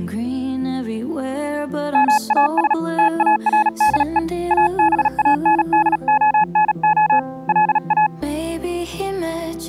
Morse code, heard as a keyed tone, hand-sent with a paddle, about 37 wpm, 850 Hz. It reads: MAS TARDE ABANDONO LA